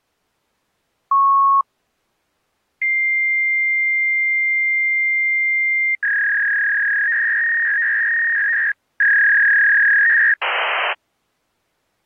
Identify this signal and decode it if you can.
Fax machine handshake, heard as a beep, a long tone, a warble and hiss.